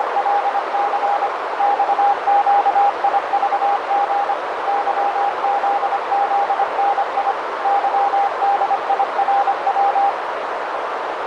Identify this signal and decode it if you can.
Morse code, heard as a keyed tone, machine-sent, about 25 wpm, 810 Hz, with heavy radio static and a narrow filter. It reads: … XQIVG YZZNI YDIRW